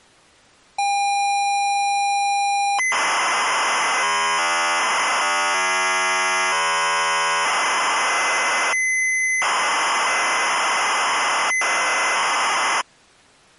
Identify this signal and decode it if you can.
ZX Spectrum tape loading, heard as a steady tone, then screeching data.